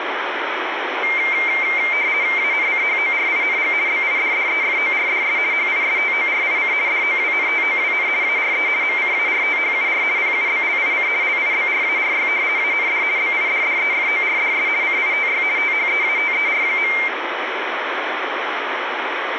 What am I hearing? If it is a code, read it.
RTTY (50 baud, 170 Hz shift), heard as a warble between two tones, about 2200 Hz centre, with radio static. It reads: ANCHORING BIDDEFORDS HISTORIC DOWNTOWN ARE MCARTHUR PUBLIC LIBRARY AND BIDDEFORDS CITY THEATER.